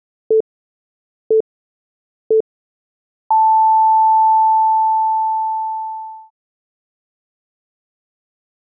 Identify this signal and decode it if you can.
Radio time signal (three low pips and a long one an octave up, as on NHK), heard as pips.